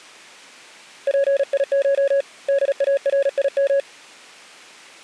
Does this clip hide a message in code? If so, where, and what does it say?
Yes: Morse code (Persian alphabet) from 1.0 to 3.9 s, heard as a keyed tone, hand-sent with a paddle, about 36 wpm, 560 Hz. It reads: پیش داریم